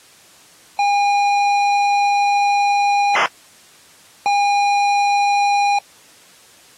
ZX Spectrum tape loading, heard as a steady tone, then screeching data.